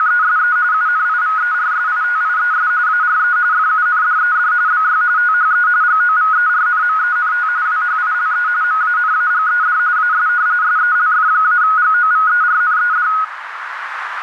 RTTY (45.45 baud, 170 Hz shift), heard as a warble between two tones, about 1360 Hz centre, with radio static and a narrow filter. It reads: … UNIVERSITIES ARE FUNDED BY THE GOVERNMENT WHILE MANAGED AS SELF-GOVERNED